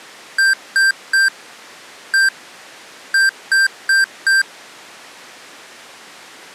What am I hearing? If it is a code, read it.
Beep code, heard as beeps from a small speaker, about 1600 Hz. 3-1-4. In Phoenix BIOS tables: interrupt mask register failure.